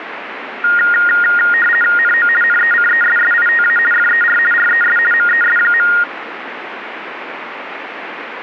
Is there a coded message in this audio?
Yes: RTTY (50 baud, 450 Hz shift) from 0.6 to 6.0 s, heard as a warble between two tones, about 1650 Hz centre, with radio static. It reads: NO NECESSITA FER RES MES.